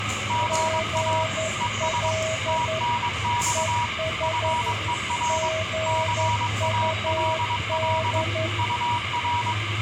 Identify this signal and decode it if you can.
Morse code, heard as two keyed tones, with radio static, room echo and the noise of a subway station. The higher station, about 22 wpm, 960 Hz: GA ES TNX FER CALL UR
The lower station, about 11 wpm, 640 Hz: GL ES GUD